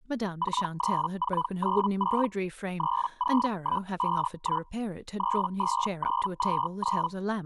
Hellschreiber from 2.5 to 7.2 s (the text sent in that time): 30151 32929